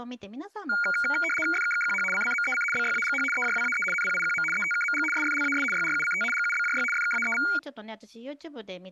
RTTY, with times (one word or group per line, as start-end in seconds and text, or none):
1.5-2.0 FKKQH
2.1-2.6 CCMEC
2.7-3.2 BYAGH
3.3-3.8 EJWAE
3.9-4.4 NPIQM
4.5-5.0 ETKMG
5.1-5.6 SFLAS
5.7-6.2 YRUCT
6.3-6.8 GUBJY
6.9-7.4 FKAEV